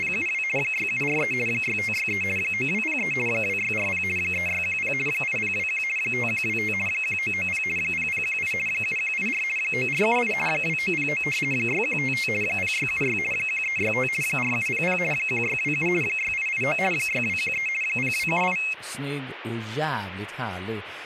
RTTY (50 baud, 450 Hz shift), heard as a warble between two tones, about 2350 Hz centre, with speech in Swedish. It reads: … 6743 6563 9203 2640 3610 8021 5125 1990 0018 7184 9478 2909 6155 0676 1365 4700 1627 6889 6213 0278